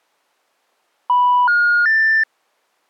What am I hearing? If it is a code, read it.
Telephone call progress tone (North American plan), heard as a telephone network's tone, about 980, 1430, 1800 Hz. Special information tone.